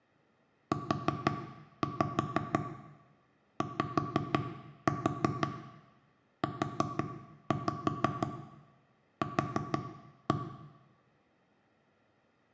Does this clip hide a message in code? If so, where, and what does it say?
Yes: tap code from 0.7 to 10.4 s, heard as knocks on wood, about 5 knocks a second, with room echo. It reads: UYUQ